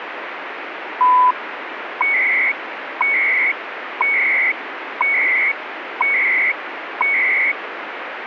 Radio time signal (CHU, Canada), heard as beeps and data bursts, one a second, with radio static.